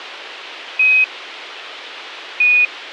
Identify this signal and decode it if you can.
Quindar tones, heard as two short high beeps.